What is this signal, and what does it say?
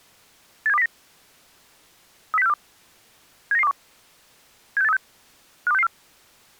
Five-tone selective call (EEA), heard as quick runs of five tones, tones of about 40 ms. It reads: 87209 30642 79921 76836 52664